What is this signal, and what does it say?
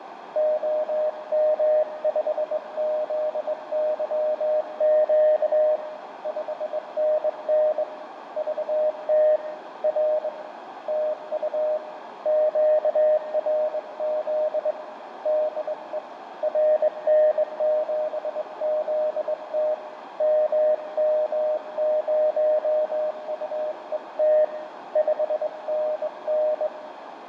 Morse code, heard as a keyed tone, hand-sent with a straight key, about 21 wpm, 610 Hz, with radio static, fading, a narrow filter and room echo. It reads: OM5ZYQ 5NN VT R TU QRZ DE RN7ZT MM0UET 5NN